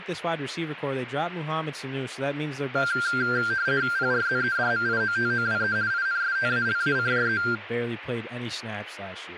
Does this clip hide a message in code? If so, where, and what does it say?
Yes: RTTY (50 baud, 170 Hz shift) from 2.8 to 7.6 s, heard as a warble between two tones, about 1480 Hz centre, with radio static and speech in English. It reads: PRZEDMIOTOWE INSTALACJE